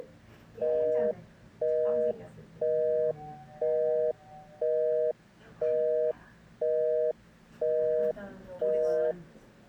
Telephone call progress tone (North American plan), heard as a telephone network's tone, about 480, 620 Hz, 0.5 s on and 0.5 s off, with the noise inside a lift. Busy tone.